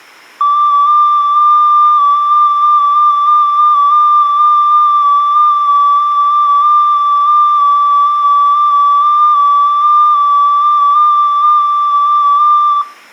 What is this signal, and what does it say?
FT8 (one signal), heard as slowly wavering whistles, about 6.25 baud, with room echo.